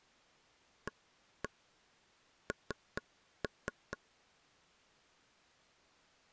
Tap code, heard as taps on a table, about 4 knocks a second. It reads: AN